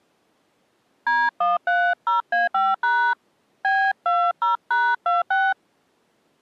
DTMF, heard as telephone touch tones, dialled by hand, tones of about 220 ms. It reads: D130A5# B20#26